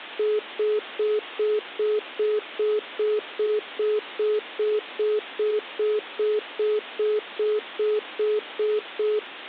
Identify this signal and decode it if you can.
Telephone call progress tone (single-tone plan, as in most of Europe), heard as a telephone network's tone, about 420 Hz, 0.2 s on and 0.2 s off. Congestion tone.